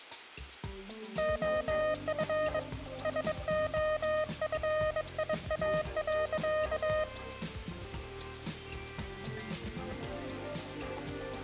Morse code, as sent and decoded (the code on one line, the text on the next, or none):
--- ..-. / ... --- ..-. .. .- .-.-.-
OF SOFIA.